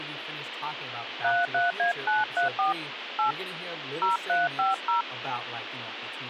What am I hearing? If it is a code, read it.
DTMF, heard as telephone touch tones, dialled by hand, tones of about 160 ms, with phone line noise and speech in English. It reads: 33A934 8 0350